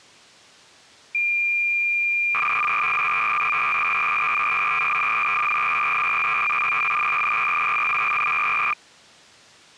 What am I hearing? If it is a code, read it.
Cassette data (Kansas City type), 300 baud, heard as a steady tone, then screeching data.